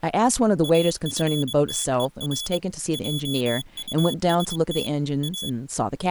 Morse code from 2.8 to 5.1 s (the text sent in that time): JUST